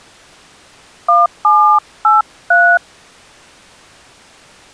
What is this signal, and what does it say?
DTMF, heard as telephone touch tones, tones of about 250 ms. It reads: 1783